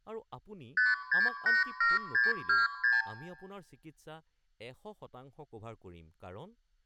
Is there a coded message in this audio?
Yes: multi-frequency trunk signalling (R2, with the far end's replies) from 0.8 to 3.1 s, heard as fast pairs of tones, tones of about 170 ms, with room echo and speech in Assamese. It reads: 5687626